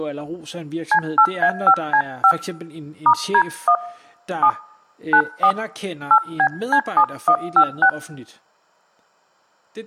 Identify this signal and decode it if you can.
DTMF, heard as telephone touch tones, dialled by hand, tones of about 80 ms, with speech in Danish. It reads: C8A5C5 *D1 7 94 8BC7156